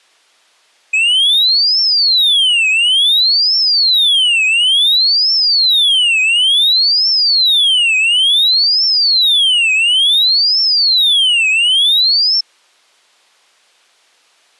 A tone that sweeps in pitch again and again. There is no code.